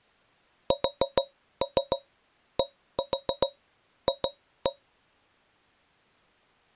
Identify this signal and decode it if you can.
Tap code, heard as taps on a metal pipe, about 7 knocks a second. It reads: SDF